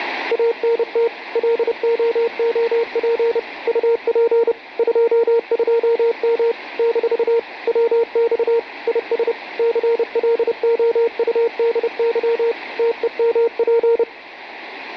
Morse code, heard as a keyed tone, machine-sent, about 30 wpm, 460 Hz, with radio static. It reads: ANT LOOP UP 22M - WX IS CLOUDY TEMP